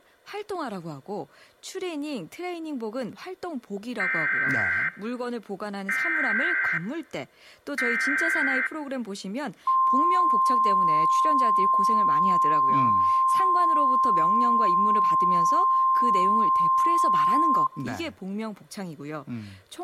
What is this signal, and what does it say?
Emergency Alert System (SAME) tones (header bursts, then the 1050 Hz attention tone), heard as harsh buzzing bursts, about 520.83 baud, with speech in Korean.